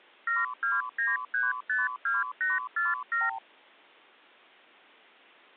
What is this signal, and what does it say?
Multi-frequency trunk signalling (R2, with the far end's replies), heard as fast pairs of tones, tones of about 180 ms. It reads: 729352847